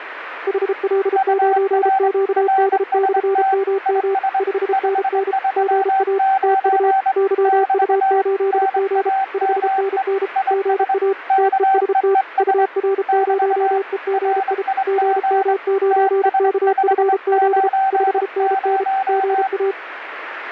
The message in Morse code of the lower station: HL9QD/MM 5NN GA TU YU8G 5NN GA TEST UR0EGI GM9KFZ 5NN GA

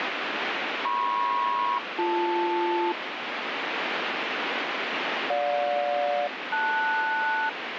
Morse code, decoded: none

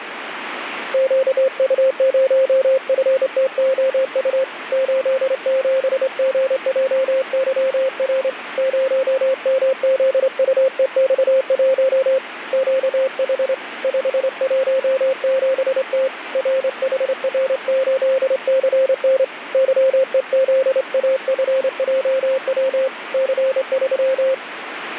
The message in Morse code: QU0FTOU 87GJYR 0MZUEX1 QH 517T RHR8CN YEZAFJW C3

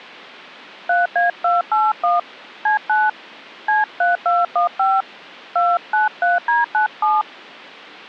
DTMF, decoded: 3A281 C9 C3215 293D97

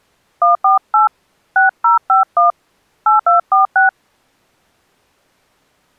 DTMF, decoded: 148 6051 8246

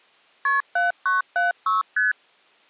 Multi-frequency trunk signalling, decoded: KP 7976 ST

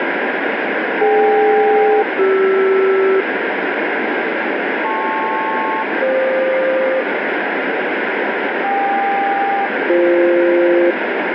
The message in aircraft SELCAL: DK-CR LP-FQ KQ-BF

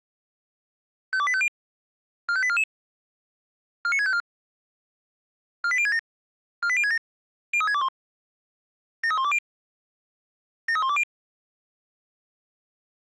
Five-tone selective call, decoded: 52850 45844 49654 48067 48067 03621 73120 73120

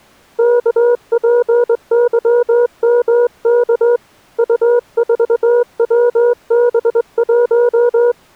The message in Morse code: KPYMK U4WB1

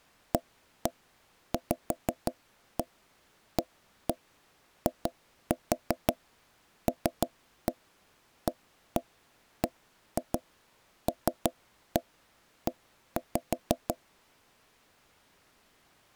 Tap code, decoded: AVAILABLE

